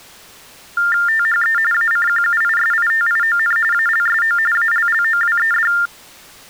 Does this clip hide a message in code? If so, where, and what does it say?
Yes: TTY/TDD text telephone tones (45.45 baud Baudot) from 0.8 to 5.9 s, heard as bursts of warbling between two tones, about 400 Hz shift, 1600 Hz centre. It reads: THE ACQUISITION ALSO ALLOWED